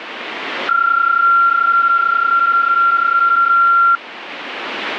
PSK31 (31.25 baud), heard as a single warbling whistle, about 1380 Hz, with radio static.